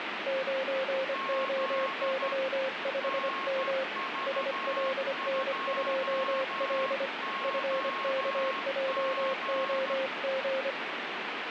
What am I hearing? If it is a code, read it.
Morse code, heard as two keyed tones, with radio static. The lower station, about 25 wpm, 530 Hz: 9OY5M SLN2L FKJOG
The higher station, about 13 wpm, 1080 Hz: Z NV2OG